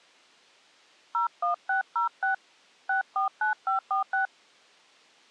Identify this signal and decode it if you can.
DTMF, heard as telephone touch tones, dialled by hand, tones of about 120 ms. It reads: 01606 649546